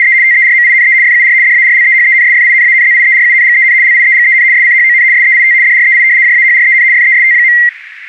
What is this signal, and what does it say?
RTTY (75 baud, 170 Hz shift), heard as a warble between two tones, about 2000 Hz centre, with radio static. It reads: … TERMINE FUR DARLEHENSFINANZIERUNGEN LIEGEN SCHON SEIT DREI JAHREN FEST.